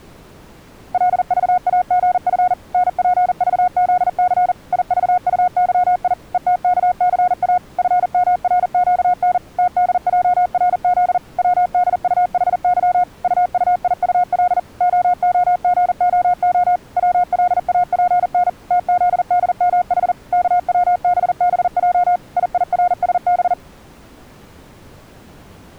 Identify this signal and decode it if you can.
Morse code, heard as a keyed tone, machine-sent, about 40 wpm, 720 Hz. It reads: LVAGF NPVZC IVUYI ETKCA FMRQN TDJRZ WDUHY UUIUL OOGOO WLAPN TZDMH KWBBJ IIRSB